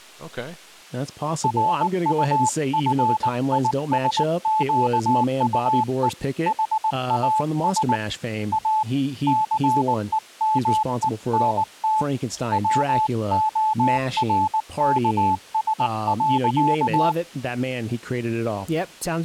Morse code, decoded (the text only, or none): RUFISQUE HAS A CEMENT WORKS.